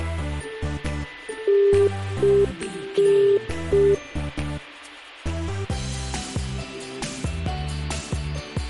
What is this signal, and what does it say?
Telephone call progress tone (UK plan), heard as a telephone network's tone, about 400 Hz. Congestion tone.